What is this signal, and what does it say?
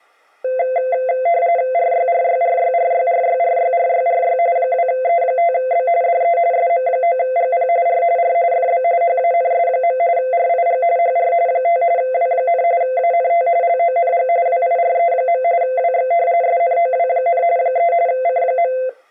RTTY (45.45 baud, 170 Hz shift), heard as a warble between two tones, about 600 Hz centre. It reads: RYRYRYRYRYRYRYRY 2E5B DE SM9GP R R FB HANS. RIG HR 5 W, ANT LONG WIRE. WX SNOW, 3 C.